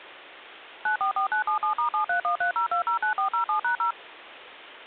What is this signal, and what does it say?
DTMF, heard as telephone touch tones, dialled by machine, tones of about 110 ms. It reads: 944977*73130209407#0